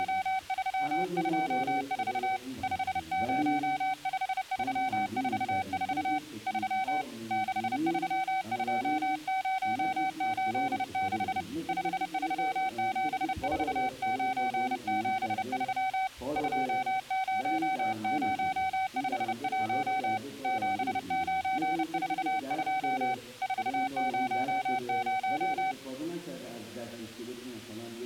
Morse code, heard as a keyed tone, hand-sent with a paddle, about 30 wpm, 760 Hz. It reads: … 505344 3 632086 5374973 20051 7942 400